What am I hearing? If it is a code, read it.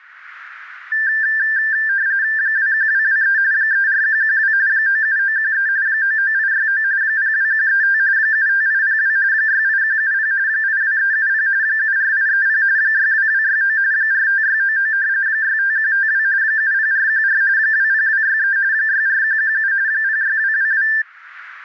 RTTY (45.45 baud, 170 Hz shift), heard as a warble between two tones, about 1700 Hz centre. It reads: 21223 34112 97913 99869 02135 75802 68170 82370 74830 62269 45699 65152 70414 20263 64117 06222